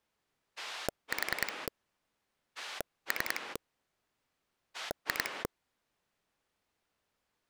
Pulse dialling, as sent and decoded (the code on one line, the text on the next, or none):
4 / 3 / 2
4 3 2